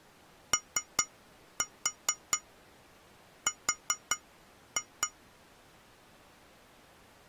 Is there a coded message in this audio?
Yes: tap code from 0.5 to 5.2 s, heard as taps on glass, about 4 knocks a second. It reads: OR